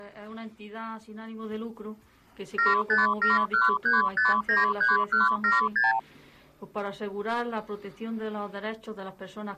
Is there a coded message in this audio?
Yes: multi-frequency trunk signalling (R2, with the far end's replies) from 2.6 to 6.0 s, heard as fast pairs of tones, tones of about 160 ms. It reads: 75713593176